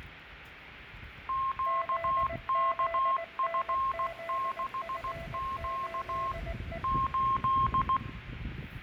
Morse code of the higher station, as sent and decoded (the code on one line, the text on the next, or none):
--.- -.- ..-. -.... --.- / ---..
QKF6Q 8